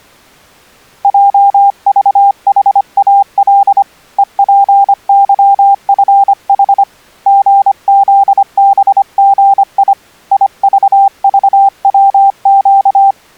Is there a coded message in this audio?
Yes: Morse code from 1.0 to 13.2 s, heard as a keyed tone, hand-sent with a paddle, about 25 wpm, 790 Hz. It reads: JVHAL EPYFH GZBGI IVVWQ